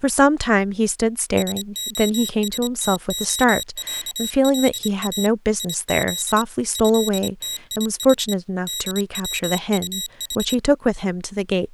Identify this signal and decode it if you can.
Morse code (Russian alphabet), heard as a high beeper, machine-sent, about 25 wpm, 3850 Hz, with speech in English. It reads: СОСТОЯЛА ИЗ ЭТИХ ДВУХ